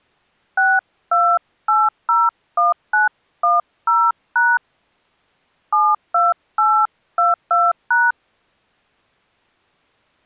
DTMF, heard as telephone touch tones, dialled by hand, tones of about 200 ms. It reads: 62801910# 72822#